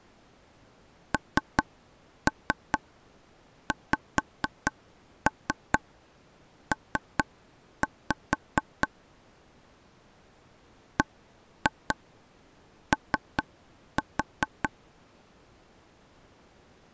Tap code, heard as taps on a table, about 4 knocks a second. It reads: NXP BO